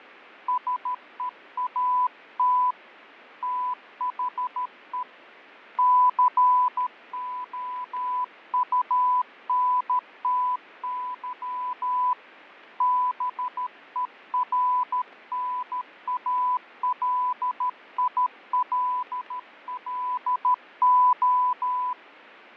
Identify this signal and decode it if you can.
Morse code, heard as a keyed tone, hand-sent with a paddle, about 13 wpm, 1000 Hz, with radio static and fading. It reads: SEAT THE COUNTY BERNALILLO